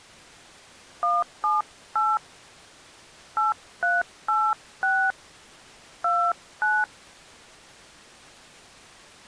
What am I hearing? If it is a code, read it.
DTMF, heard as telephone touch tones, dialled by hand, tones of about 210 ms. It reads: 178 8386 29